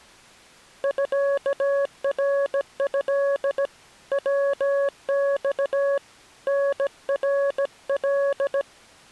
Morse code (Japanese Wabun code), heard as a keyed tone, hand-sent with a bug key, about 17 wpm, 560 Hz. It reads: ミナト ヤマ タナカ